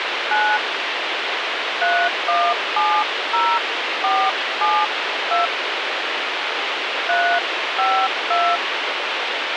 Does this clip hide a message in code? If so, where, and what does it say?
Yes: DTMF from 0.3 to 8.6 s, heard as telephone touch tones, dialled by hand, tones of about 260 ms, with radio hiss. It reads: 9 3170472 352